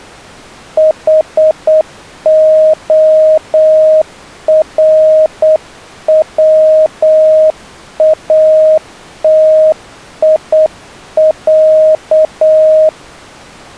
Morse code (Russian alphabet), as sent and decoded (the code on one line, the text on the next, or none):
.... --- .-. .-- .- - .. .-.-
ХОРВАТИЯ